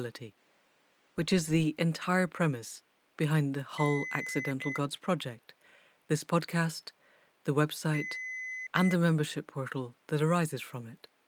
Beep code, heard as beeps, played twice, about 2050 Hz, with speech in English. 1 long, 1 short. In IBM BIOS tables: system board problem.